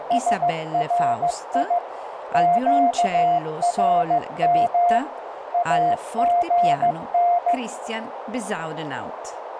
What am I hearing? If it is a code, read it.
Morse code, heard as a keyed tone, machine-sent, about 15 wpm, 700 Hz, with radio static, a narrow filter and speech in Italian. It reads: SRI QRM AGN